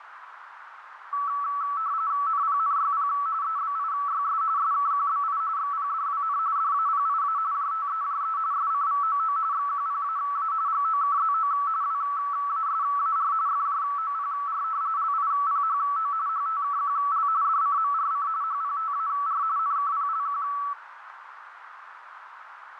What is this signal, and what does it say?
RTTY (45.45 baud, 170 Hz shift), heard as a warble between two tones, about 1230 Hz centre, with radio static and a narrow filter. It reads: NPNYP EBIYS SKQBI XPDWN DAPIA JTEJE SCVOO XQPAA GOKZO WASAR FJOPR LIPHO HTKQL DCMRC HPTAR NKPLQ